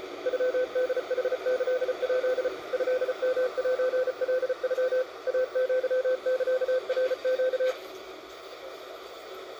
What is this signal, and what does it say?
Morse code (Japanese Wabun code), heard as a keyed tone, machine-sent, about 34 wpm, 510 Hz, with the noise inside a bus. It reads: ノホヌキヱ トヨセカノ イアサナネ